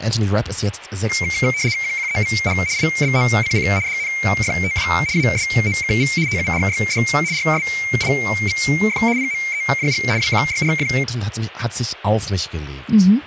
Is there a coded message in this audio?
Yes: RTTY (75 baud, 170 Hz shift) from 1.1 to 11.0 s, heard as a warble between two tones, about 2200 Hz centre, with speech in German. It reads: QQEVH IBOCC DNFTW ASOKV TURYD RSIVF PMEJG WQYRF